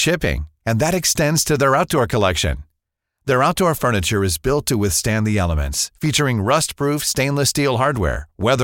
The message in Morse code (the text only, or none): none